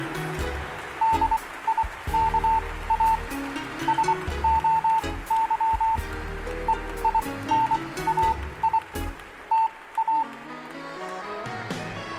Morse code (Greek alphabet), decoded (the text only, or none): ΔΙΚΑ ΣΟΥ ΕΙΝΑΙ ΤΑ